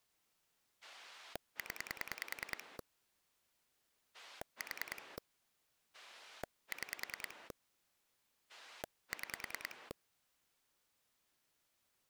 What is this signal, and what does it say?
Pulse dialling, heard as a rotary dial, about 10 pulses a second. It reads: 0 4 6 6